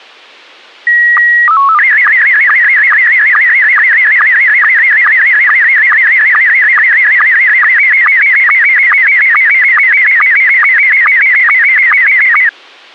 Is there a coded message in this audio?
Yes: SSTV (slow-scan television), Scottie S1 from 0.9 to 12.5 s, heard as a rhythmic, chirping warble.